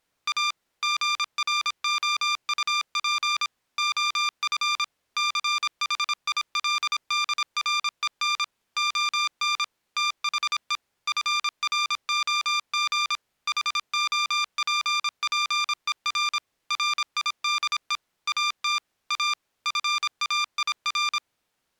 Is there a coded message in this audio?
Yes: Morse code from 0.2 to 21.2 s, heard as electronic beeps, machine-sent, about 26 wpm, 1190 Hz. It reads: A GROUP OF CHILDREN ON THE FROG HOPPER RIDE AT A FAIR